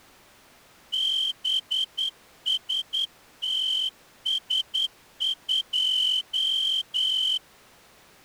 Morse code, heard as a whistle, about 10 wpm. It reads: BSTS2